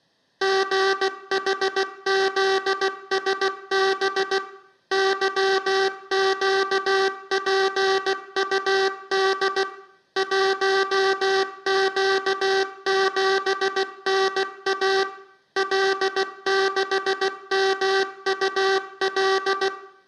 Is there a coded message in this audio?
Yes: Morse code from 0.4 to 19.7 s, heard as a buzzer, machine-sent, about 16 wpm, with room echo. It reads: GHZSB YQPUD 1Q7NA L6MUL